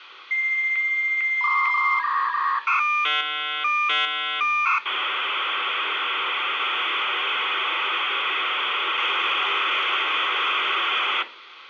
Dial-up modem handshake (V.34 or later), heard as a whistle, warbles, then hiss, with phone line noise and room echo.